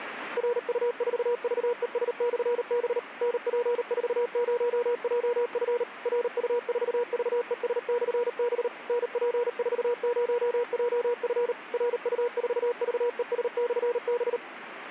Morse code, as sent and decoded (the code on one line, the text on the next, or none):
.-. ..- ....- ...- . ... -..-. -... / -. .--. ....- ----- .--- ..-. / .-. ..- ....- ...- . ... -..-. -... / -. .--. ....- ----- .--- ..-. / .-. ..- ....- ...- . ... -..-. -...
RU4VES/B NP40JF RU4VES/B NP40JF RU4VES/B